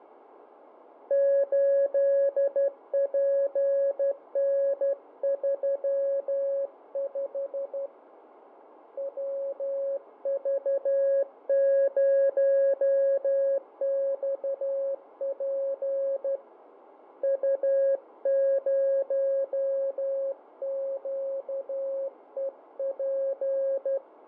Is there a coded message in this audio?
Yes: Morse code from 1.0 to 24.0 s, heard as a keyed tone, hand-sent with a straight key, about 12 wpm, 550 Hz, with radio static and fading. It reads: 8PN35 WV0XP U0QEP